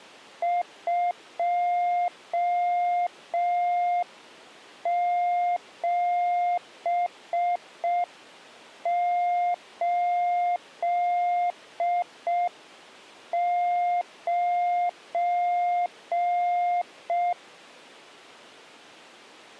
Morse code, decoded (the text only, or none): 2789